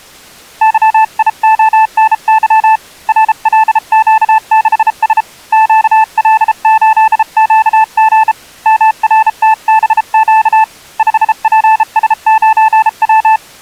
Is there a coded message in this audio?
Yes: Morse code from 0.6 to 13.4 s, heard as a keyed tone, hand-sent with a bug key, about 33 wpm, 880 Hz. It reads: YIONY RLQ6S QL8QG MRTBQ 5PS9W